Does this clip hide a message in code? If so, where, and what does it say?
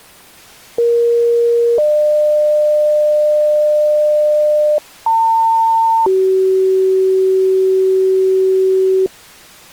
Yes: two-tone page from 0.8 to 9.1 s, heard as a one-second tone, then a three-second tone, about 470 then 600 Hz, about 900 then 380 Hz.